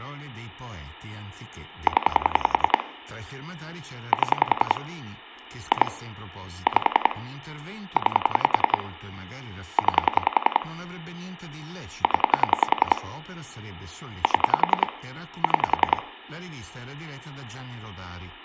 Pulse dialling, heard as clicks on a phone line, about 10 pulses a second, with room echo and speech in Italian. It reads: 0 7 2 5 9 9 0 7 6